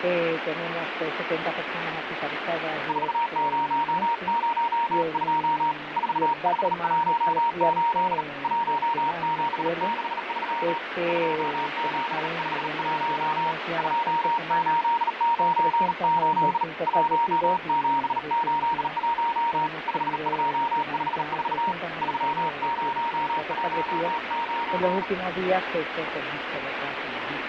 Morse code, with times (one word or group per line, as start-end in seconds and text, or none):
2.9-5.7 4002
6.0-8.2 4518
8.4-10.8 1763
11.1-13.5 2751
13.8-16.6 2898
16.9-19.7 1781
19.9-21.7 5254
22.0-25.0 3019